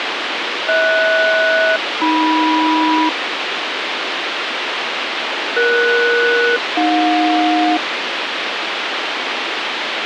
Aircraft SELCAL, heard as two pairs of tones, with radio hiss. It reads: HS-AM ES-AJ